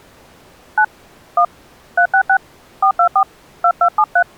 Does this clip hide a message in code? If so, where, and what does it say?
Yes: DTMF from 0.8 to 4.2 s, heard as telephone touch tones, dialled by hand, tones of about 70 ms. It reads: 9 1 366 424 2273